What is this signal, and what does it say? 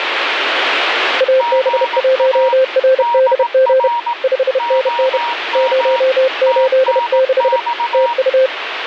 Morse code, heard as two keyed tones, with radio static. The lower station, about 31 wpm, 520 Hz: AB1RDG 5NN 086 TU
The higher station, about 18 wpm, 950 Hz: GA DR OM TNX